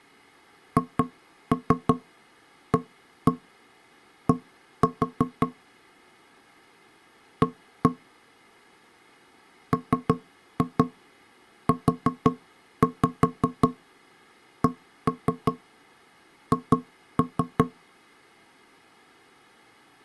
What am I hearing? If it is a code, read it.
Tap code, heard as knocks on wood, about 5 knocks a second. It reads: HAD A MUCH